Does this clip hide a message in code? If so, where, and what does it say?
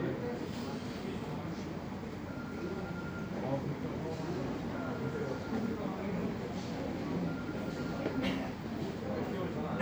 No, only the noise of a subway station.